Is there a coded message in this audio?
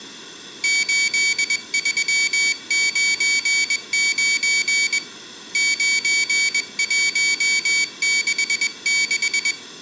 Yes: Morse code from 0.6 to 9.6 s, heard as a high beeper, hand-sent with a paddle, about 21 wpm, 2300 Hz, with room echo. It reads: 8399 9166